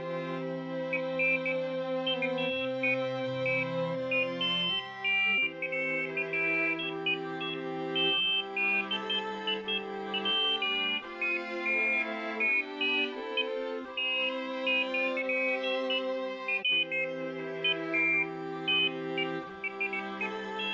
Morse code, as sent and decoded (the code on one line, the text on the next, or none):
none